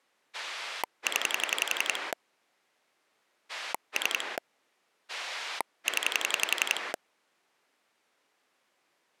Pulse dialling, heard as a rotary dial, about 11 pulses a second. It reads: 0 3 0